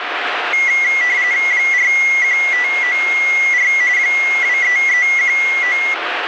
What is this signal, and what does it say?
RTTY (45.45 baud, 170 Hz shift), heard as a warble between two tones, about 2050 Hz centre, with radio static. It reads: 41594 23319